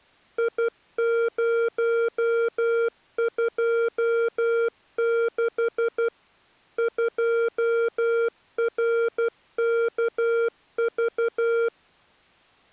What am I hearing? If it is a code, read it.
Morse code, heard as electronic beeps, machine-sent, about 12 wpm, 460 Hz. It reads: I026 2RKV